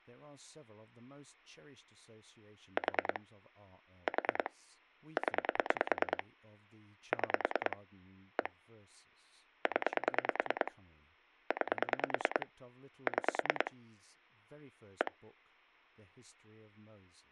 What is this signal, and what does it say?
Pulse dialling, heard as clicks on a phone line, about 9 pulses a second, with speech in English. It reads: 4 4 0 6 1 0 9 6 1